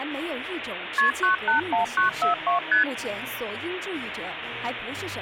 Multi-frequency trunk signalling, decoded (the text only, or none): KP 981942 ST